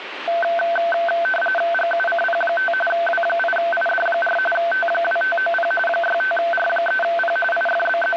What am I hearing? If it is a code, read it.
RTTY (45.45 baud, 850 Hz shift), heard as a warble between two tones, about 1100 Hz centre, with radio static. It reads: GUCP5 W8ID4 T2590 65R3P …